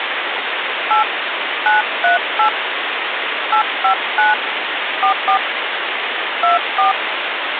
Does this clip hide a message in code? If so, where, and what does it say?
Yes: DTMF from 0.9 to 6.9 s, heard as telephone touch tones, dialled by hand, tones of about 130 ms, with phone line noise. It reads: 8 938 859 44 24